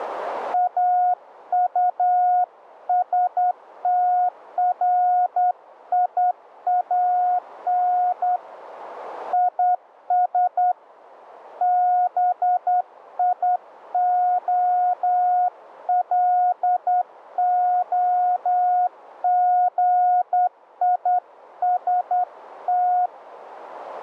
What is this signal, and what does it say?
Morse code, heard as a keyed tone, hand-sent with a straight key, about 10 wpm, 720 Hz, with radio static. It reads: AUSTRIAN IS BIOLOGIST